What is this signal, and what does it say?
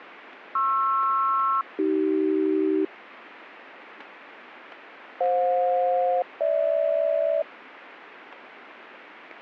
Aircraft SELCAL, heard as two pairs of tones, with radio static. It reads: PR-AC FJ-GH